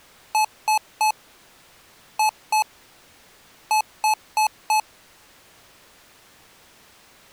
Beep code, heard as beeps from a small speaker, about 860 Hz. 3-2-4. In Phoenix BIOS tables: keyboard controller failure.